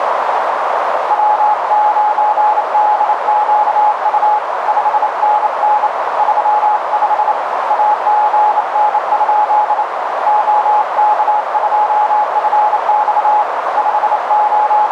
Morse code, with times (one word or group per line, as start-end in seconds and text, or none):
1.1-4.4 W9DQU
4.7-5.9 5NN
6.2-7.3 35
7.7-9.8 AGN?
10.3-13.4 OK2FX
13.8-14.9 …